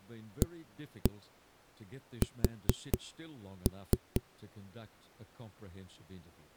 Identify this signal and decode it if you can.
Tap code, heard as knocks on a wall, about 4 knocks a second, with speech in English. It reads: AS